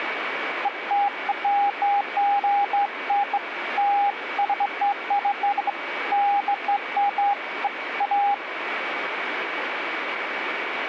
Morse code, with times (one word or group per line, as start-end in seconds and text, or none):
none